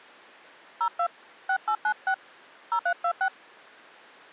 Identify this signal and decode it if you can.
DTMF, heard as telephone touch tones, dialled by hand, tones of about 80 ms. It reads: 02 6896 0326